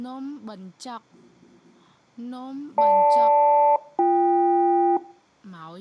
Aircraft SELCAL, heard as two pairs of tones. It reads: GL-BK